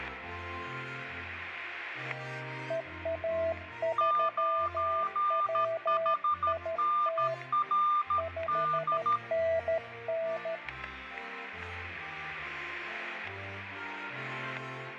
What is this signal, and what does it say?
Morse code, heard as two keyed tones, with static crashes and room echo. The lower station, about 13 wpm, 660 Hz: EA3WIT 5NN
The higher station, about 13 wpm, 1200 Hz: 9HNRD